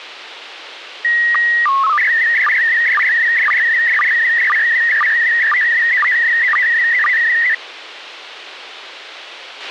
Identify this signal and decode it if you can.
SSTV (slow-scan television), PD 120, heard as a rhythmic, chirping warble, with radio hiss and a squelch burst at the end.